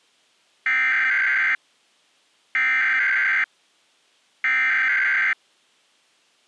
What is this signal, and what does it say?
Emergency Alert System (SAME) tones (header bursts), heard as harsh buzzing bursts, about 520.83 baud.